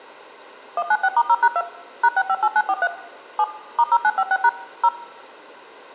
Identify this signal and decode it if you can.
DTMF, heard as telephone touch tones, dialled by machine, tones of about 50 ms, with room echo. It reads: 196*0#2 #658943 7 *0956# 0